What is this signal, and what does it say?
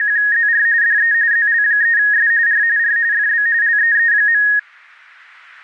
RTTY (45.45 baud, 170 Hz shift), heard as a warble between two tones, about 1750 Hz centre. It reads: … DE ZL3S R R FB LEE.